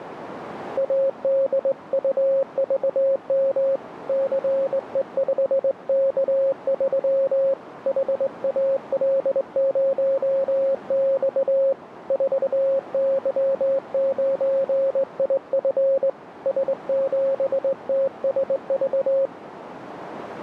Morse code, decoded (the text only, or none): ADUVM CE5K3 HAL0X 4Y9IF S7TSV